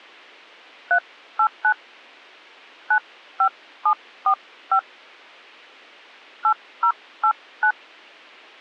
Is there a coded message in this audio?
Yes: DTMF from 0.9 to 7.7 s, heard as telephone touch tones, dialled by hand, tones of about 80 ms. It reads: 389 95745 8089